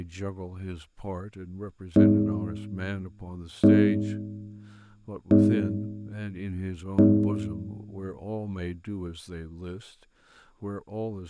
Clock strike, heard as a bell, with room echo and speech in English. 4. Four o'clock.